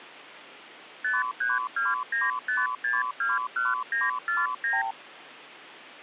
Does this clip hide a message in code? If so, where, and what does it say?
Yes: multi-frequency trunk signalling (R2, with the far end's replies) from 1.0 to 4.9 s, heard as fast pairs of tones, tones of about 180 ms. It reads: 53295621949